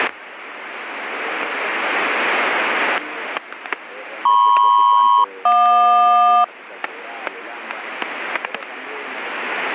Aircraft SELCAL, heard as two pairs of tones, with static crashes. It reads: MP-JQ